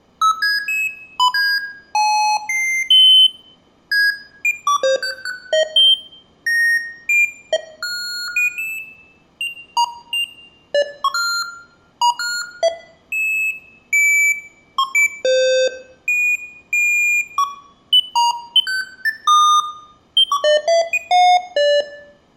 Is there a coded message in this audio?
No, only electronic bleeps of random pitch and length, with room echo.